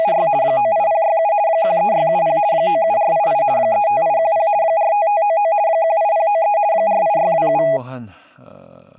RTTY (50 baud, 170 Hz shift), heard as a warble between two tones, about 740 Hz centre, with speech in Korean. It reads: … 98067 13670 97488 35810 45599 18093 48627